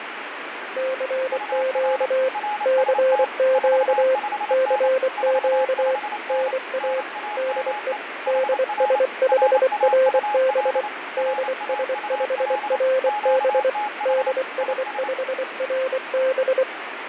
Morse code, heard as two keyed tones, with radio static and fading. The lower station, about 24 wpm, 520 Hz: CQ CQ CQ NA DE DS5RB DS5RB DS5RB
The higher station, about 28 wpm, 840 Hz: UR RST 45N 45N NAME HR RAUL RAUL QTH IS